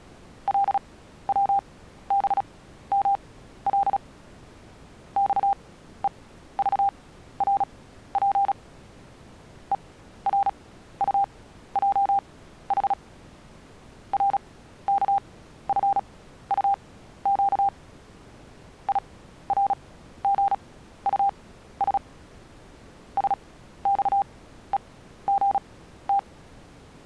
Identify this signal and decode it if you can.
Morse code, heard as a keyed tone, machine-sent, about 36 wpm, spaced as for 14 wpm, 800 Hz. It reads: LWBML XEVRP ERUJH RKFUQ IRGUS SXEGT